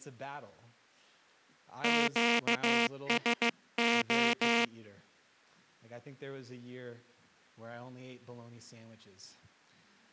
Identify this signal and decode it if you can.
Morse code, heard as a buzzer, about 15 wpm. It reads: QSO